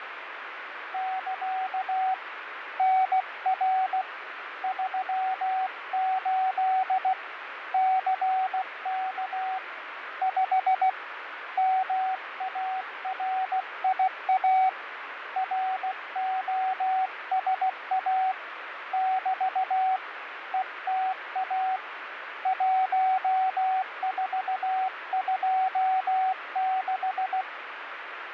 Morse code, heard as a keyed tone, hand-sent with a paddle, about 16 wpm, 760 Hz, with radio static and fading. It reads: <KA> NR 38 CK 5 MARIA ROSA <BT> ETA 1426